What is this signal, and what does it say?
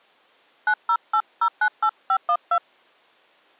DTMF, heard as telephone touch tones, dialled by hand, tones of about 70 ms. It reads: 908098512